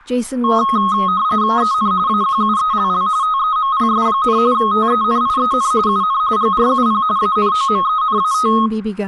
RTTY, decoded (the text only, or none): EN AQUELL TEMPS, TENIEN UN GRUP ANOMENAT